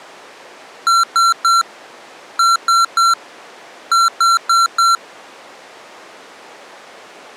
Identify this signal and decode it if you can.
Beep code, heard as beeps from a small speaker, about 1360 Hz. 3-3-4. In Phoenix BIOS tables: video failure.